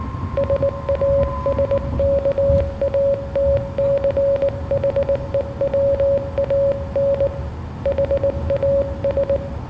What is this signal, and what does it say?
Morse code, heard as a keyed tone, hand-sent with a bug key, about 19 wpm, 560 Hz, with room echo and the noise inside a car. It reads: SASKATCHEWAN HAS